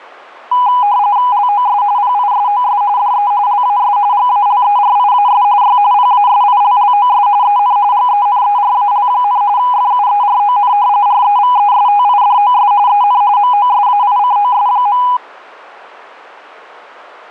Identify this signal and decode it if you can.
RTTY (45.45 baud, 170 Hz shift), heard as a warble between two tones, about 910 Hz centre. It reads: LOS PISOS DE LAS GALERIAS Y PASILLOS EN GENERAL, FUERON REVESTIDOS EN MOSAICOS.